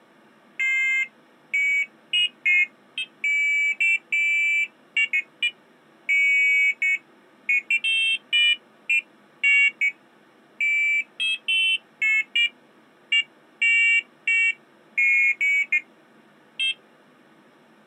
Pairs of high tones at irregular times. There is no code.